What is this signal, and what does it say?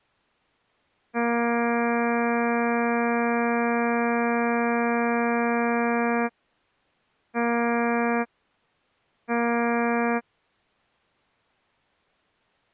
Ship horn signal, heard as a ship's horn, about 240 Hz. 1 long, 2 short. At sea: a vessel in fog that is sailing, fishing, towing or hampered.